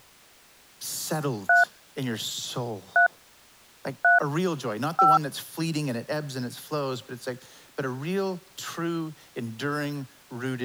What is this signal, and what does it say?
DTMF, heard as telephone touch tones, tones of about 160 ms. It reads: 3 3 3 5